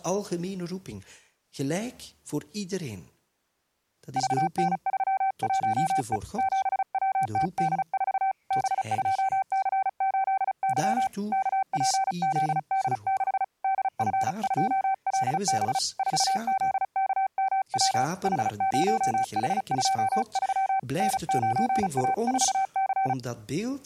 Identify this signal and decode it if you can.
Morse code, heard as a keyed tone, hand-sent with a paddle, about 35 wpm, 770 Hz. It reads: VN31E 7WTD4 B2C8Y KPZD6 DF2LB 4ZKMW H0H23 N9A4C